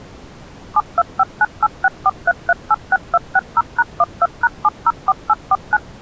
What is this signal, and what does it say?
DTMF, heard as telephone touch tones, dialled by machine, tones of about 40 ms. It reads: 72598643386260#12#704849